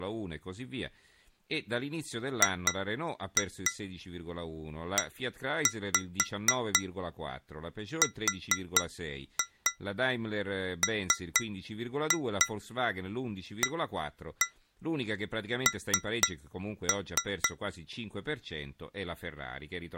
Tap code, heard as taps on glass, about 4 knocks a second, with speech in Italian. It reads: GERMAN